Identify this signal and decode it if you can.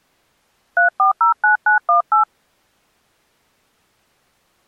DTMF, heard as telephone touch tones, dialled by hand, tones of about 120 ms. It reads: 3409918